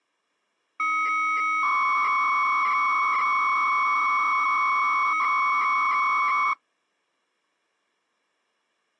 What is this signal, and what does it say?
300-baud modem data (Bell 103 tones), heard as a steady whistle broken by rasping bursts, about 300 baud, 200 Hz shift.